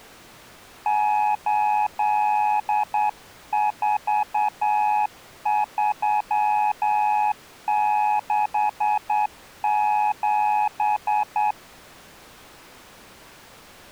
Morse code, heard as a keyed tone, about 9 wpm, 840 Hz. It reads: 84367